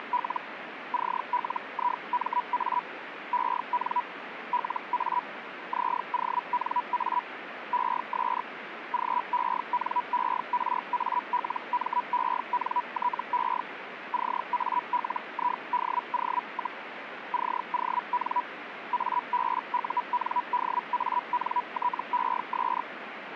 Hellschreiber (Feld-Hell, 122.5 baud), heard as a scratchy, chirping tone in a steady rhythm, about 980 Hz, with radio static. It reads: … CLIMA EN LA ZONA ES GENERALMENTE CALIDO, CON ABUNDANTES